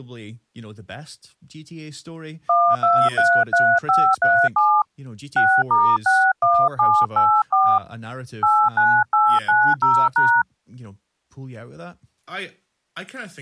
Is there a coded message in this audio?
Yes: DTMF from 2.5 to 10.4 s, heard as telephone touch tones, dialled by hand, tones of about 260 ms, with speech in English. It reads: 1233537 6*61784 89890#